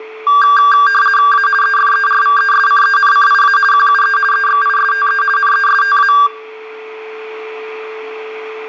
RTTY (50 baud, 450 Hz shift), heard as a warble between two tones, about 1380 Hz centre, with a steady whistle near 440 Hz and room echo. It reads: A EFERVESCENCIA QUE EXISTE NESTA